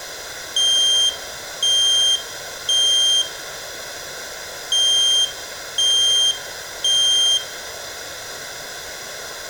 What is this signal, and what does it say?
Alarm pattern, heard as an alarm's beeps, played twice, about 3200 Hz, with room echo. Temporal three. Smoke or fire, evacuate.